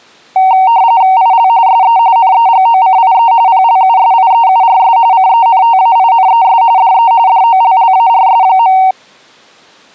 RTTY (45.45 baud, 170 Hz shift), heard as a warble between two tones, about 840 Hz centre. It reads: IL SE NEGOCIE PLUSIEURS CENTAINES DE DOLLARS.